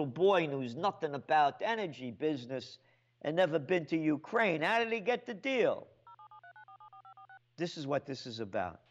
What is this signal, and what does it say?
DTMF, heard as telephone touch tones, dialled by machine, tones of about 80 ms, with a squelch burst at the end. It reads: 07739474546